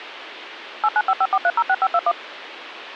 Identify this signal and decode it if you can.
DTMF, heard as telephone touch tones, dialled by machine, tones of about 50 ms, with phone line noise. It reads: 89554306521